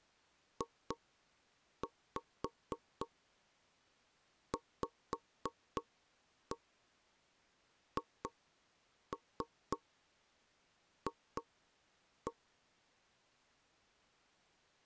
Tap code, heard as knocks on wood, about 3 knocks a second. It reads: JVHF